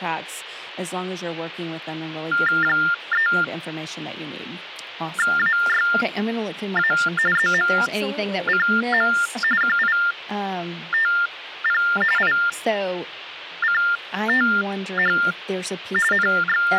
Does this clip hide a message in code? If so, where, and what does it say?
Yes: TTY/TDD text telephone tones (45.45 baud Baudot) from 2.3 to 16.8 s, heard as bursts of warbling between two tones, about 400 Hz shift, 1600 Hz centre, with speech in English. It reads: 3AYA ZMCM QITP ICTH …